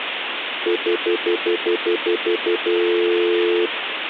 Telephone call progress tone (North American plan), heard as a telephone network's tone, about 350, 440 Hz, 0.1 s on and 0.1 s off, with phone line noise. Stutter dial tone.